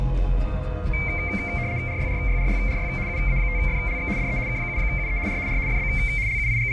RTTY (75 baud, 170 Hz shift), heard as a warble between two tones, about 2200 Hz centre, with fading. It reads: RYRYRYRY UA5FLX DE K7UE R R FB …